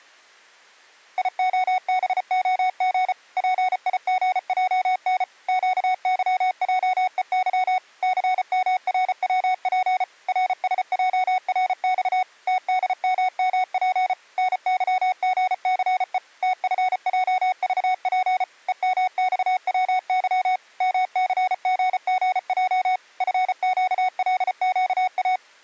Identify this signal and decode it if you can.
Morse code, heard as electronic beeps, machine-sent, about 34 wpm, 740 Hz. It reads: IOBOG PIGJN QYJEY CMRWP RSJRX TDMMP NYGCE TFJVP EMXWY MCGGJ FQLQA